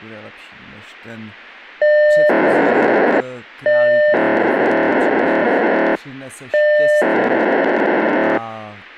POCSAG pager data (1200 baud), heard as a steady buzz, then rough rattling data, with speech in Czech.